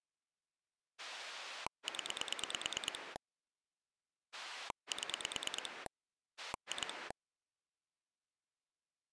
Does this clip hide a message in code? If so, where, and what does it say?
Yes: pulse dialling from 1.0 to 7.1 s, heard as a rotary dial, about 9 pulses a second. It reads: 0 7 2